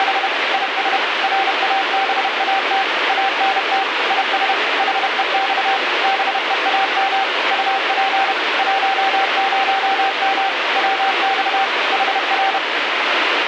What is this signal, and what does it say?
Morse code, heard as a keyed tone, machine-sent, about 31 wpm, 780 Hz, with radio static. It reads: … IS RABAT ANT IS HEX BEAM UP 10M WX HR